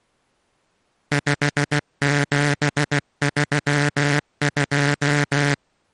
Morse code, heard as a buzzer, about 16 wpm. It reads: 5732